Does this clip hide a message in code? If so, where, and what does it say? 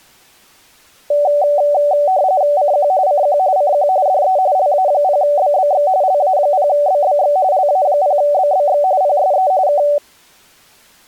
Yes: RTTY (45.45 baud, 170 Hz shift) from 1.1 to 10.0 s, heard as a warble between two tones, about 670 Hz centre. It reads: CQ CQ CQ DE LA0BBX LA0BBX LA0BBX PSE K